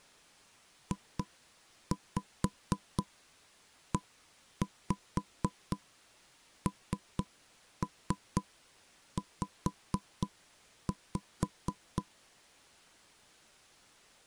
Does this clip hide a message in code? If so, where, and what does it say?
Yes: tap code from 0.9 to 12.1 s, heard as knocks on wood, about 4 knocks a second. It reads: JENZ